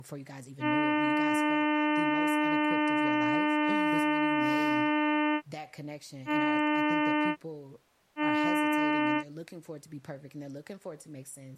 Ship horn signal, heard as a ship's horn, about 300 Hz, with speech in English. 1 long, 2 short. At sea: a vessel in fog that is sailing, fishing, towing or hampered.